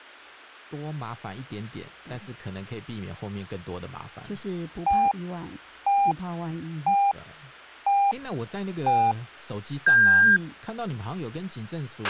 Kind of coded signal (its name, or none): radio time signal